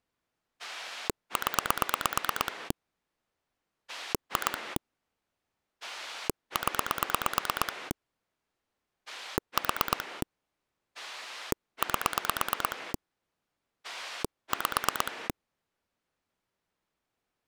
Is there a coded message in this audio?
Yes: pulse dialling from 0.6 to 15.3 s, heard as a rotary dial, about 8 pulses a second. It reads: 0 2 0 4 8 5